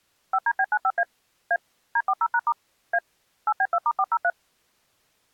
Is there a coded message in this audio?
Yes: DTMF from 0.3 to 4.3 s, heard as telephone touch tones, dialled by machine, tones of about 60 ms. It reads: 5DB95A A D40#* A 8B2*403